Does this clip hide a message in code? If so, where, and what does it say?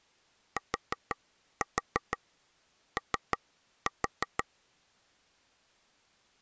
Yes: tap code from 0.6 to 4.4 s, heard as taps on a table, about 6 knocks a second. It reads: TO